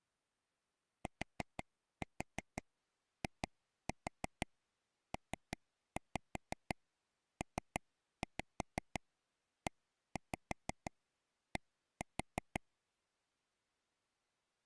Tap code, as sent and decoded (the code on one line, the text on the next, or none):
4-4 2-4 3-5 3-5 1-5 1-4
TIPPED